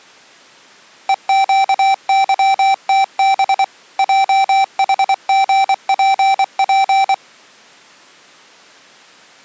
Morse code, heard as electronic beeps, machine-sent, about 24 wpm, 780 Hz. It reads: EQYTB JHGPP